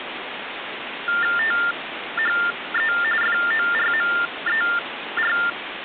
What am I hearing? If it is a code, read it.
TTY/TDD text telephone tones (45.45 baud Baudot), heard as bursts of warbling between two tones, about 400 Hz shift, 1600 Hz centre, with phone line noise. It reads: THE FORMER